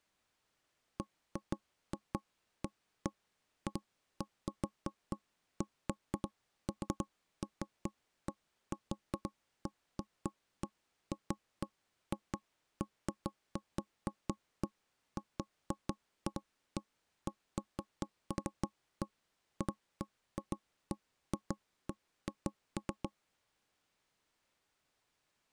Irregular knocks on wood. There is no code.